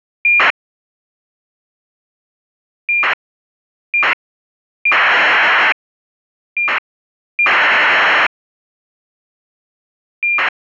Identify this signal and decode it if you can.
ACARS aircraft data, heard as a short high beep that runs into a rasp, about 2400 baud.